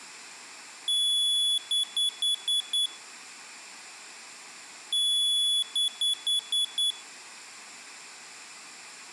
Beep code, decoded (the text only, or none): 1 long, 5 short